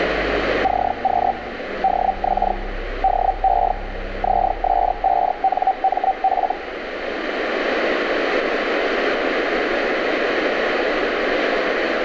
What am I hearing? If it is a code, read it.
Hellschreiber (Feld-Hell, 122.5 baud), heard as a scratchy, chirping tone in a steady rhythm, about 770 Hz, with radio static. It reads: CQ DX DE ZS5NMF